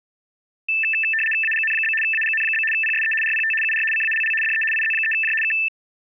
RTTY (75 baud, 850 Hz shift), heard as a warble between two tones, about 2200 Hz centre. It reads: AGN? AGN? PSE RPT UR CALL DE IZ3J K